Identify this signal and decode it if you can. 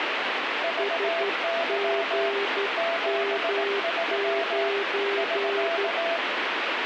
Morse code, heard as two keyed tones, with heavy radio static. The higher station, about 18 wpm, 670 Hz: VY 73 <SK>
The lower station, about 12 wpm, 400 Hz: SGM9